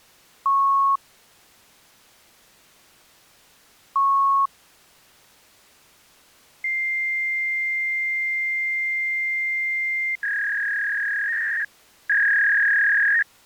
Fax machine handshake, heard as beeps, a long tone and a warble.